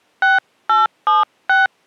DTMF, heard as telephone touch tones, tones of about 160 ms. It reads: 6876